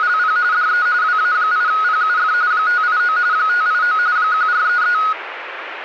RTTY (45.45 baud, 170 Hz shift), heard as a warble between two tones, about 1360 Hz centre, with radio static. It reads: … DE WA8PUF 589 589 1433